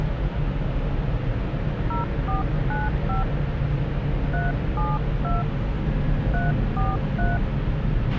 DTMF, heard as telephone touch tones, dialled by hand, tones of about 180 ms, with radio hiss, a squelch burst at the end and the noise inside a lift. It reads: 0495 372 343